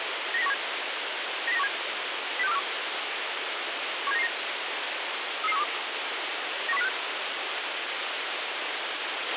Five-tone selective call (EEA), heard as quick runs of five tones, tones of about 40 ms, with radio hiss and a squelch burst at the end. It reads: 90917 90917 06241 17999 33312 91056